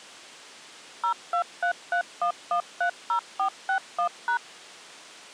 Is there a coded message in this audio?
Yes: DTMF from 1.0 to 4.4 s, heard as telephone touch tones, dialled by machine, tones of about 90 ms. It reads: 02331130461#